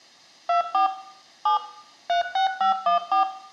DTMF, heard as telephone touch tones, dialled by machine, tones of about 120 ms, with room echo. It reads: 24 7 36514